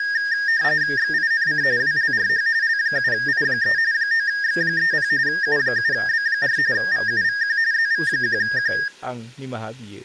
RTTY (45.45 baud, 170 Hz shift), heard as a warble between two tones, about 1750 Hz centre, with speech in Bodo. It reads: XINC WLRH L7I3 9X30 U7B4 VUVQ ZV1Q